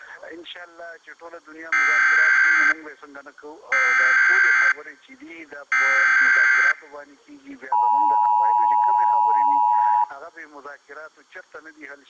Emergency Alert System (SAME) tones (header bursts, then the 853 and 960 Hz attention tone), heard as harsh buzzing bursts, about 520.83 baud.